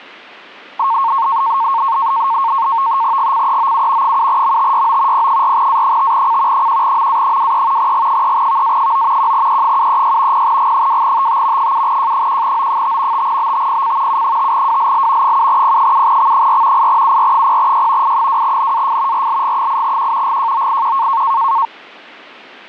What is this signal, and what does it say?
NAVTEX (SITOR-B), 100 baud, 170 Hz shift, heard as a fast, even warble, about 1000 Hz centre. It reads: GCEOU 7MTYO P4A5C 1MA23 G3VA9 1E736 0G2TT 7J1O5 5BTPC U5WLL 7P7X4 8UR0Y I2NAF RLG8Q GJOIQ